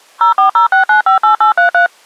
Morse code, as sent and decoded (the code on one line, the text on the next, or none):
none